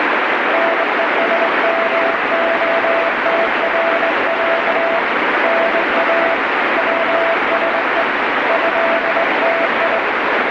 Morse code (Russian alphabet), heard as a keyed tone, hand-sent with a straight key, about 22 wpm, 670 Hz, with heavy radio static. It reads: НЕСМОТРЯ НА ВСЕ ЭТИ